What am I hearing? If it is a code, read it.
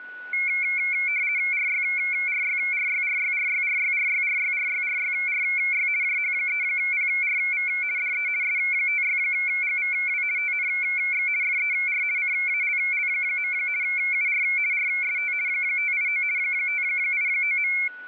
RTTY (50 baud, 170 Hz shift), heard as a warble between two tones, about 2250 Hz centre, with a steady whistle near 1480 Hz. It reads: RYRYRYRYRYRYRYRYRYRYRY JH3PRV DE S56GVW TNX FER CALL. UR RST 589 589.